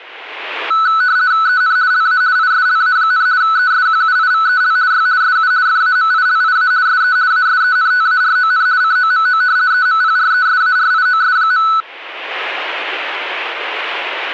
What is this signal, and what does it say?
RTTY (50 baud, 170 Hz shift), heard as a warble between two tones, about 1400 Hz centre. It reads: EN LA ISLA, ESQUIVEL Y SU FAMILIA SE ASENTARON COMO EMPRESARIOS.